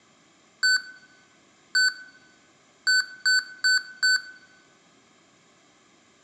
Beep code, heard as beeps from a small speaker, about 1500 Hz, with room echo. 1-1-4. In Phoenix BIOS tables: BIOS ROM checksum failure.